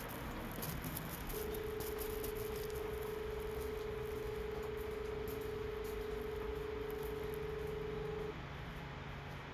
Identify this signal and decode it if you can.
Telephone call progress tone (as in Australia), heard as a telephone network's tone, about 430 Hz, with phone line noise and the noise inside a lift. Dial tone.